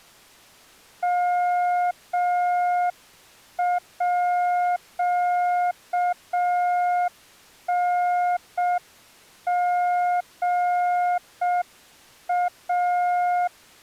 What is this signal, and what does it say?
Morse code (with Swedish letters), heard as a keyed tone, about 6 wpm, 710 Hz. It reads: MÅNGA